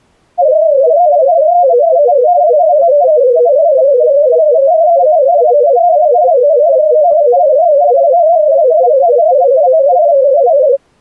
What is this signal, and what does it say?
Multi-tone FSK (Olivia or MFSK type), about 250 Hz wide, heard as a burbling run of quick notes, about 31.25 baud.